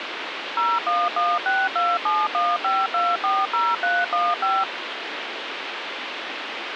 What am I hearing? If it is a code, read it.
DTMF, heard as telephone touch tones, dialled by machine, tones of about 220 ms, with phone line noise. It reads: 01162715240315